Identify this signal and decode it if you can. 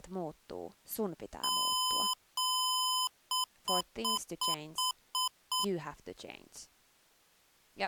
Beep code, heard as beeps from a small speaker, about 1020 Hz, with speech in Finnish. 2 long, 7 short.